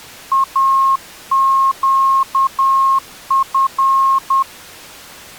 Morse code, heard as a keyed tone, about 10 wpm, 1080 Hz. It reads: AQF